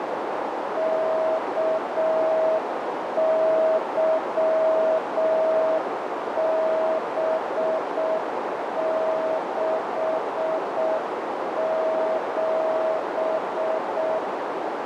Morse code, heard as a keyed tone, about 6 wpm, 640 Hz, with heavy radio static and a narrow filter. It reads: KYB67